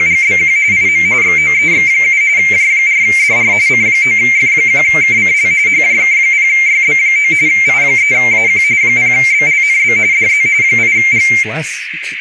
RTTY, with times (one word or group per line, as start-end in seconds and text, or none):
0.0-0.6 …
0.7-1.1 IM
1.2-2.2 XOEX7
2.4-3.5 J4DR
3.7-5.5 C9F1KCL
5.7-7.3 HJK0YB9
7.5-8.6 I3AQ
8.8-10.0 0BLNB
10.1-10.5 DZ
10.6-11.3 8G